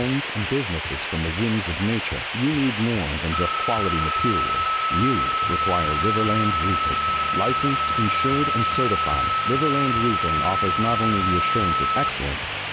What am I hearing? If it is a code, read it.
PSK31 (31.25 baud), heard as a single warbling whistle, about 1300 Hz, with radio static.